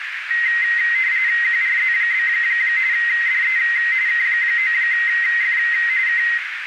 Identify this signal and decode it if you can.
RTTY (45.45 baud, 170 Hz shift), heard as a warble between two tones, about 1950 Hz centre, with radio static and a narrow filter. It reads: QRZ? DE K9F K